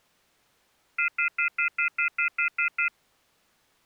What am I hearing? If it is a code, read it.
Telephone call progress tone (North American plan), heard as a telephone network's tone, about 1400, 2050, 2450, 2600 Hz, 0.1 s on and 0.1 s off. Off-hook warning tone.